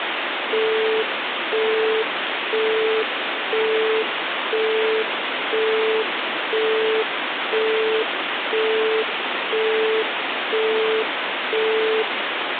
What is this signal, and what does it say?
Telephone call progress tone (single-tone plan, as in Europe, Japan and elsewhere), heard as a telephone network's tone, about 440 Hz, 0.5 s on and 0.5 s off, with phone line noise. Busy tone.